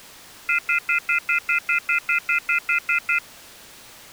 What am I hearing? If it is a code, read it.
Telephone call progress tone (North American plan), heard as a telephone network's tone, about 1400, 2050, 2450, 2600 Hz, 0.1 s on and 0.1 s off. Off-hook warning tone.